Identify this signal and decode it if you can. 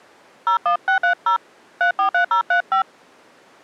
DTMF, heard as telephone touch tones, dialled by hand, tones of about 100 ms. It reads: 01630 343035